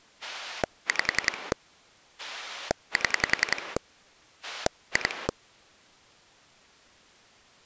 Pulse dialling, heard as a rotary dial, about 10 pulses a second. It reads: 5 7 2